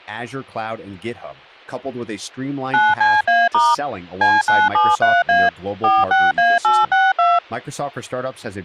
DTMF, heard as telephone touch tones, dialled by machine, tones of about 200 ms, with speech in English. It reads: 9CA* C973A 46A862